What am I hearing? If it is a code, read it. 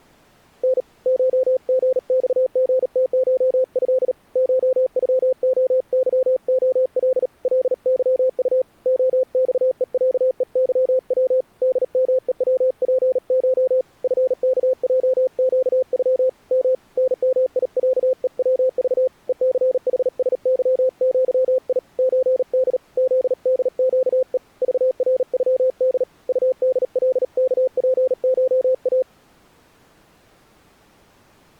Morse code (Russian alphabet), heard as a keyed tone, hand-sent with a paddle, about 38 wpm, 520 Hz. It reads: Н ШГЬГТШЭ ШЮОЫОЛ ЛЫУ ОЬЕЯЕЫВ ДМЕВПШ ФКЙЩЮ М НМИЯЕВЖ ЕЦХСЫЪИ ЧД ЗДЩЕ ЖРЮД УДЛКПША